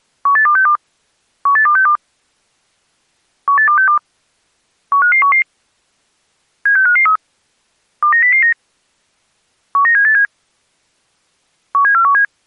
Five-tone selective call (CCIR), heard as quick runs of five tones, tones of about 100 ms. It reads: 18262 18262 18262 15511 76553 29009 19787 17417